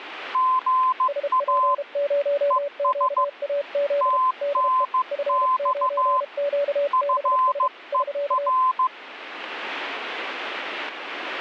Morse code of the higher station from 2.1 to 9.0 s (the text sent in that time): ES TNX FER